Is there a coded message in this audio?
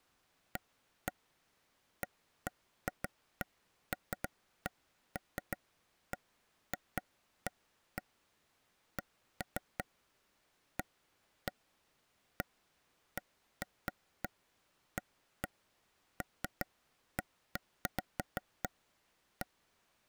No, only irregular taps on a table.